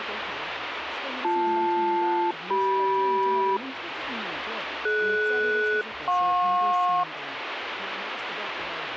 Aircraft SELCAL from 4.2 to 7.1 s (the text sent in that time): DS-JP